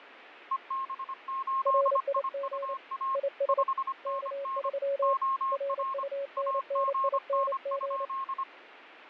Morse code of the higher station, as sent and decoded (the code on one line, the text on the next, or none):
. -... ---.. .. ..- .- / ..... -. -. / --- .-. / .- --. -. ..--..
EB8IUA 5NN OR AGN?